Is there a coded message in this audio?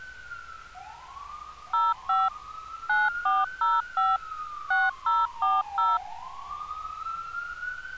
Yes: DTMF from 1.7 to 6.0 s, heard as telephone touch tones, dialled by machine, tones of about 200 ms, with street noise. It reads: 05 9405 6040